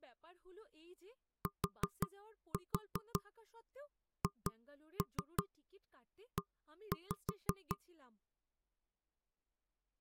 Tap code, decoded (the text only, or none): THE